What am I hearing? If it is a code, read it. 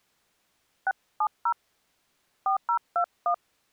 DTMF, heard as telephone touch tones, dialled by hand, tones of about 80 ms. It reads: 670 4021